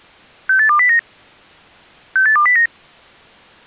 Five-tone selective call (CCIR), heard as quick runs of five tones, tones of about 100 ms. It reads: 68209 68209